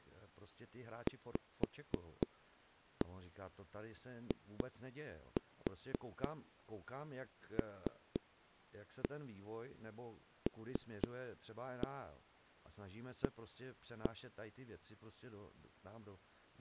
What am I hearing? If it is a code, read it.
Tap code, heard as knocks on a wall, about 4 knocks a second, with speech in Czech. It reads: VILLA